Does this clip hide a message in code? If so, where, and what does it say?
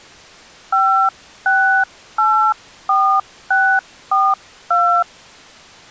Yes: DTMF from 0.7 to 5.0 s, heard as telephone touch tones, dialled by hand, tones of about 300 ms. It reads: 5684642